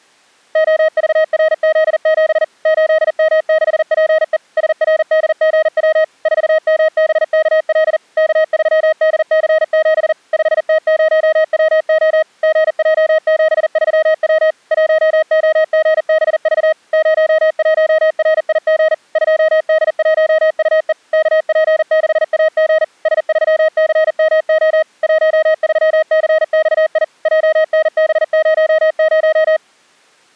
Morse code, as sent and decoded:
--- ...- .-. --.. --... / ---.. -- -.... .--. . / ... .-. -.. --. .-- / ....- -- -... -.- .-.. / -.- ...-- -.. -.-. --... / ..... - ----- .-- --- / --. .--- --... ...-- .-- / .---- --- --. -... ...- / ----- .---- .-. .. --. / ..--- -.. .---- ..- . / -.- .--. -.... .- --. / ... ...-- -.-. -- --- / .---- ...-- -.-. -..- .. / .--- -. -... ----- -----
OVRZ7 8M6PE SRDGW 4MBKL K3DC7 5T0WO GJ73W 1OGBV 01RIG 2D1UE KP6AG S3CMO 13CXI JNB00

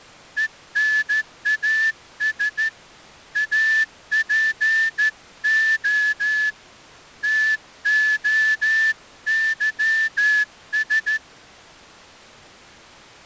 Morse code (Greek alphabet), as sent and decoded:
. -. .- ... / .- .--. --- / - --- -.-- ...
ΕΝΑΣ ΑΠΟ ΤΟΥΣ

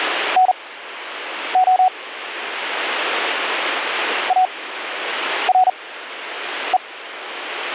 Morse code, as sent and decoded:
-. --- / .- .-. .
NO ARE

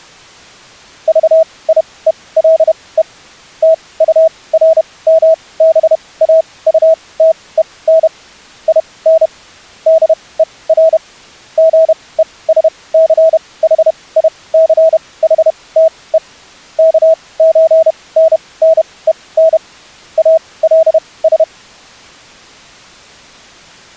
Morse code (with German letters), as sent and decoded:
...- .. . .-.. . / - ..- .-. -- -... .- ..- - . -. / .. -. / -.. . .-. / --. . ... -.-. .... .. -.-. .... - . / -.- ---. -. -. . -. / .- .-.. ...
VIELE TURMBAUTEN IN DER GESCHICHTE KÖNNEN ALS

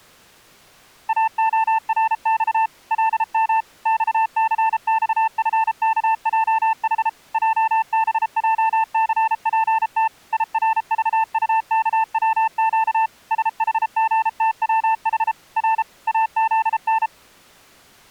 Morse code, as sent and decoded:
.- --- .-. -..- / .-.. -- / -..- -.-. -..- ..-. -.- .--- .... / .--- -... .--- -.-. .--. - / .. .-. ...- ..- -.- .-- --.- / ... .... --. - .-- .... / .-. / .- --.. -.
AORX LM XCXFKJH JBJCPT IRVUKWQ SHGTWH R AZN

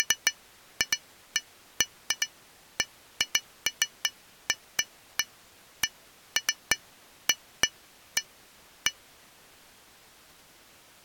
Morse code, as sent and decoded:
none

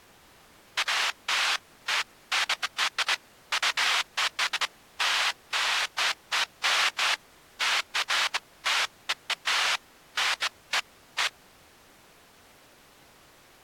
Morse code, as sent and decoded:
none

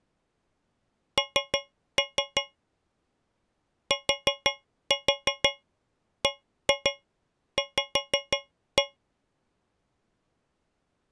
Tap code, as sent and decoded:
3-3 / 4-4 1-2 5-1
N TBV

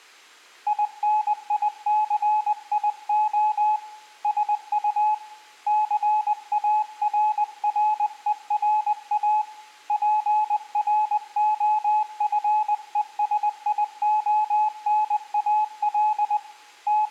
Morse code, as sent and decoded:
.. -. .. -.-. .. --- / ... ..- / -.-. .- .-. .-. . .-. .- / .--. .-. --- ..-. . ... .. --- -. .- .-.. / …
INICIO SU CARRERA PROFESIONAL …

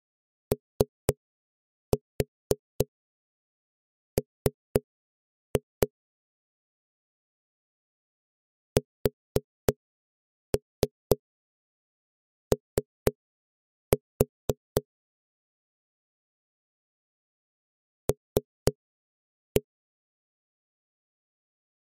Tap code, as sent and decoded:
3-4 3-2 / 4-3 3-4 / 3-1
OM SO L

